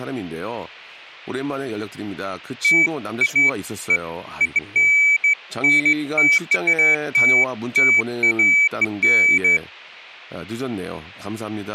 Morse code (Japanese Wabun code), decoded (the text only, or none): none